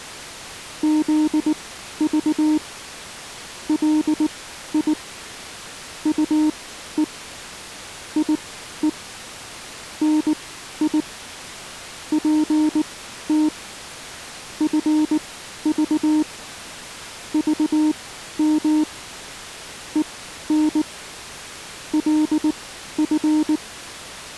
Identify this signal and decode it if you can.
Morse code, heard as a keyed tone, machine-sent, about 19 wpm, spaced as for 12 wpm, 310 Hz. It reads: ZV LI UE IE NI PT FV VM EN LF